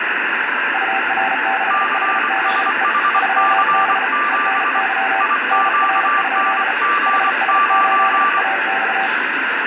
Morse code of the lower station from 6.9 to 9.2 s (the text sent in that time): HS8AX